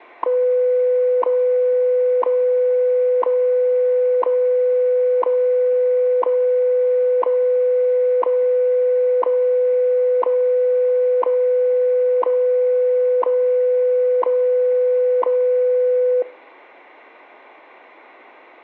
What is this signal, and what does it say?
Radio time signal (WWV, Colorado), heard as ticks, one a second, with room echo.